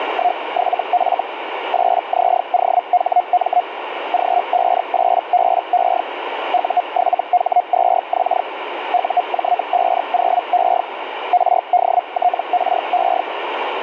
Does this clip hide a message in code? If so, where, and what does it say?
Yes: Hellschreiber (Feld-Hell, 122.5 baud) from 0.0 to 13.2 s, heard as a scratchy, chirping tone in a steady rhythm, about 720 Hz, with radio static. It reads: … 8ZOHM G58BE U7H2X UJ50E RDTRE